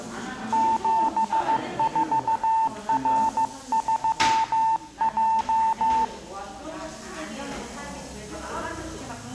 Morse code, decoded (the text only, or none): 74R3J